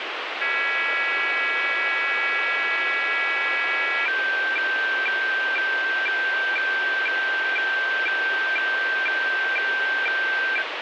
Weather fax (radiofax), 120 lines a minute, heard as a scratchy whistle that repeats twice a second, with radio static.